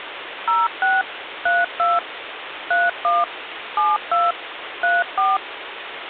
DTMF, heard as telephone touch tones, dialled by machine, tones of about 190 ms, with phone line noise. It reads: 06 32 31 72 34